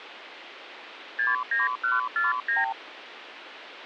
Multi-frequency trunk signalling (R2, with the far end's replies), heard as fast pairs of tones, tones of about 160 ms, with phone line noise. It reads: 69149